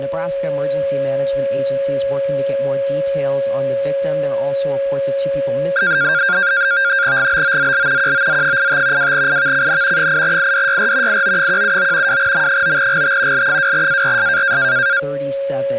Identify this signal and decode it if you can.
NAVTEX (SITOR-B), 100 baud, 170 Hz shift, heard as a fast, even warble, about 1500 Hz centre, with a steady whistle near 550 Hz and speech in English. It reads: GBOZL QOZ85 2IVCN 8IDYR IO179 2M9GT L2ARS